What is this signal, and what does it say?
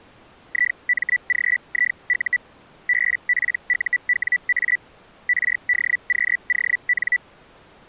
Hellschreiber (Feld-Hell, 122.5 baud), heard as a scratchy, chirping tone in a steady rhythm, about 1950 Hz. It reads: IMGIU BPUWA RDQON